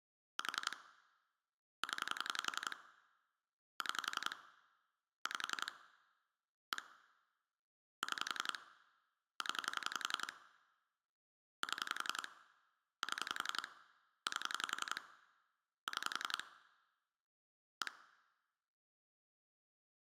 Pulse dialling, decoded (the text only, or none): 4 0 6 5 1 6 0 7 7 8 6 1